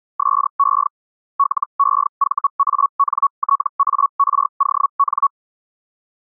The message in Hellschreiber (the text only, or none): SE LEVANTARON